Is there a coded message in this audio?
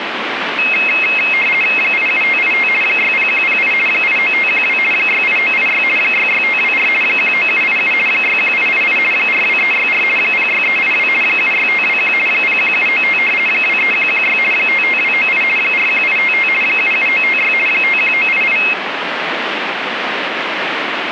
Yes: RTTY (50 baud, 450 Hz shift) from 0.6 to 18.7 s, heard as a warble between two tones, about 2350 Hz centre, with radio static. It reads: 87585 60108 89512 68986 66524 19787 61888 42364 06382 76521 01795 23116 55298 41855 77956 51988